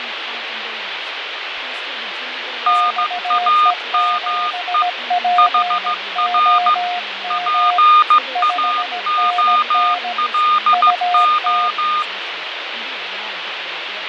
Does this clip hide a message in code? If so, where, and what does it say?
Yes: Morse code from 2.6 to 12.1 s, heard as two keyed tones, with radio static, fading and speech in English. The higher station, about 15 wpm, 1220 Hz: NAME HR PAOLO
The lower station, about 17 wpm, 710 Hz: XE7POM 5NN UT